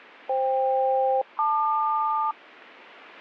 Aircraft SELCAL, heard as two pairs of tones. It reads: FK-LQ